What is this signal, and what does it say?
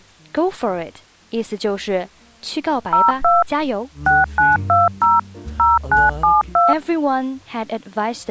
DTMF, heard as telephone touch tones, dialled by machine, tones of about 180 ms. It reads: 02 6920 0972